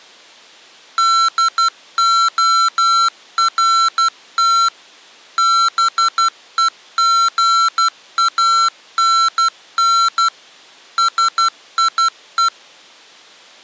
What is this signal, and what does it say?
Morse code, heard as electronic beeps, machine-sent, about 12 wpm, 1350 Hz. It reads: DORT BEGANN SIE